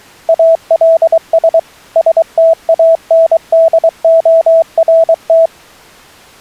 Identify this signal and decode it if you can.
Morse code, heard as a keyed tone, machine-sent, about 23 wpm, 660 Hz. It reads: ALS STANDORT